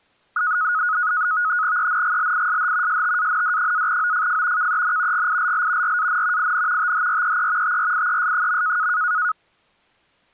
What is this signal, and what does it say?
NAVTEX (SITOR-B), 100 baud, 170 Hz shift, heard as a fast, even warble, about 1360 Hz centre. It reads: ENGLISH STAND-OFF KEN GILL RAN IN THREE TRIES.